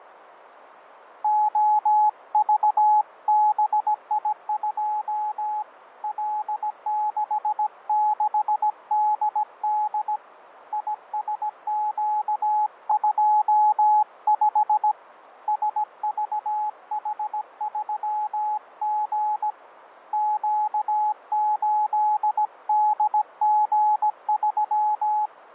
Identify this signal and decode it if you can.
Morse code, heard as a keyed tone, hand-sent with a paddle, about 17 wpm, 850 Hz, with radio static and fading. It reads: OVBI2 L66DD ISQ25 SVH3G Q8DG3